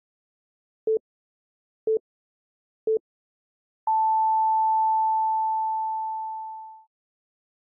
Radio time signal (three low pips and a long one an octave up, as on NHK), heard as pips.